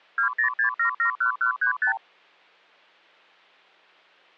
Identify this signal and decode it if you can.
Multi-frequency trunk signalling (R2, with the far end's replies), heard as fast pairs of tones, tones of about 100 ms. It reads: 206771135